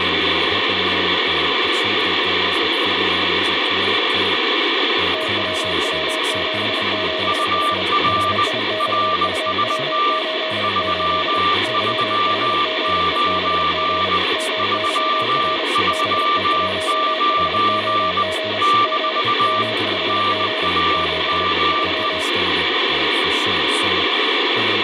Morse code, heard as two keyed tones, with radio static and speech in English. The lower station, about 31 wpm, 630 Hz: TWW77H HIXUW88 YHGEBG MYR BE1HOG G M5G 7 3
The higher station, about 20 wpm, 1180 Hz: UR RST 339 339 - NAME